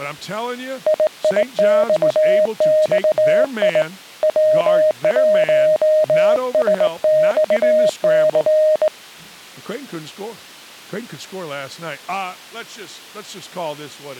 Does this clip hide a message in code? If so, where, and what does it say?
Yes: Morse code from 0.8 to 8.9 s, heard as a keyed tone, hand-sent with a straight key, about 19 wpm, 620 Hz, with speech in English. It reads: IIXXI W1SXC